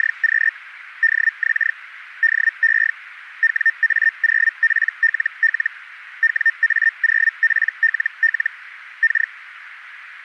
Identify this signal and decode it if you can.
Hellschreiber (Feld-Hell, 122.5 baud), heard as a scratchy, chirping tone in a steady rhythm, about 1800 Hz, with radio static. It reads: … DX DE WA0PLL WA0PLL K